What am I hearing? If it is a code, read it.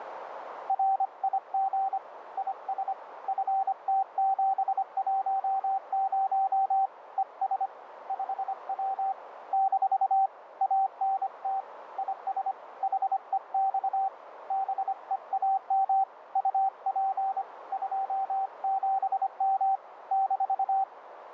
Morse code, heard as a keyed tone, hand-sent with a bug key, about 25 wpm, 780 Hz, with radio static and a narrow filter. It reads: RIG IS FT710 ES 5W - ANT IS HEX BEAM UP 27M -